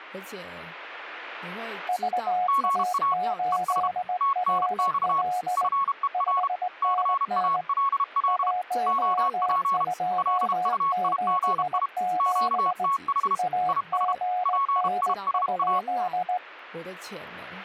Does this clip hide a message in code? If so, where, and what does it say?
Yes: Morse code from 1.8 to 16.4 s, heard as two keyed tones, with speech in Chinese. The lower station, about 19 wpm, 730 Hz: VA8RL 5NN 1277 AGN?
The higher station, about 32 wpm, 1100 Hz: GA ES TNX FER CALL OP LUIGI QTH IS PISA